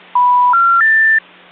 Telephone call progress tone (North American plan), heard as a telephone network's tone, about 980, 1370, 1800 Hz, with hum. Special information tone.